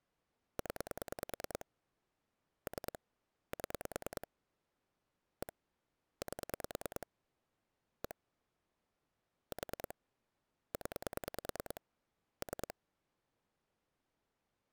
Pulse dialling, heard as clicks on a phone line, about 9 pulses a second. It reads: 0 3 7 1 8 1 4 0 3